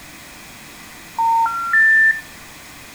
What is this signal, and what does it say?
Telephone call progress tone (North American plan), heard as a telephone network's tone, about 910, 1370, 1800 Hz, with room echo. Special information tone.